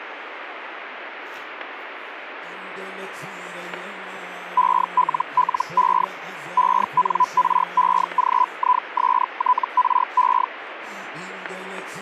Hellschreiber (Feld-Hell, 122.5 baud), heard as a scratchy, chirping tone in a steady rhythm, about 1000 Hz, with radio static. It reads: ELLE ENREGISTRE